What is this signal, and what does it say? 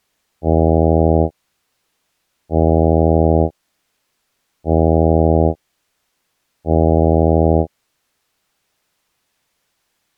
Ship horn signal, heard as a ship's horn, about 80 Hz. 4 short. At sea: a pilot vessel's identity signal in fog.